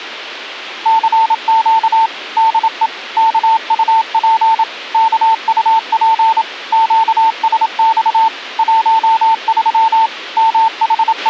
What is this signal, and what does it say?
Morse code, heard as a keyed tone, machine-sent, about 27 wpm, 900 Hz, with a squelch burst at the end. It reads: CQ DE KUP KUP QSX 13 …